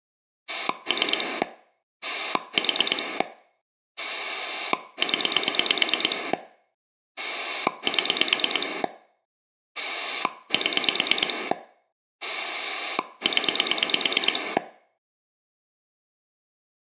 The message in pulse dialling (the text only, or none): 3 4 0 7 7 0